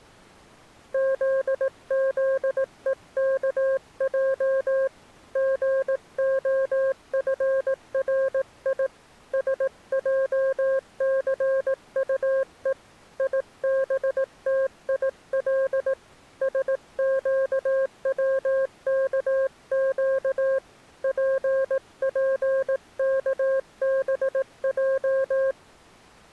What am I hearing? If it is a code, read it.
Morse code, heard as a keyed tone, hand-sent with a paddle, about 18 wpm, 540 Hz. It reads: ZZEKJ GOFRI SJCUE IBTIL SQWKQ PPKBJ